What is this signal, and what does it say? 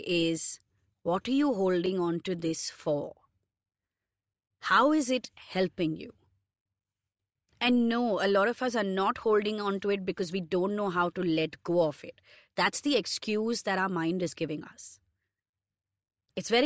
Speech in English. There is no code.